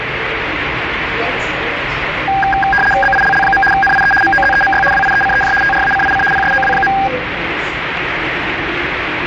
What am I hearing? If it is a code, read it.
RTTY (75 baud, 850 Hz shift), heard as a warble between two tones, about 1210 Hz centre, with radio static and the noise inside a subway train. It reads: BILL. NIE MOZEMY WIECEJ TRACIC PSOW.